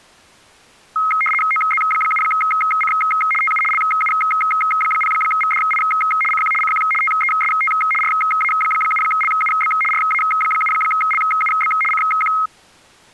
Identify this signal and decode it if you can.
RTTY (75 baud, 850 Hz shift), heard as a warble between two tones, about 1700 Hz centre. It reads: OZ7C TU LU0VDI CQ CQ TEST RA7LUB RA7LUB CQ